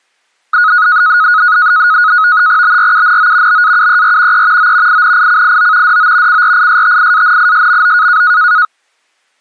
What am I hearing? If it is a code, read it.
NAVTEX (SITOR-B), 100 baud, 170 Hz shift, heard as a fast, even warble, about 1360 Hz centre. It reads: BRUNO BAUER E O INICIO DO CRISTIANISMO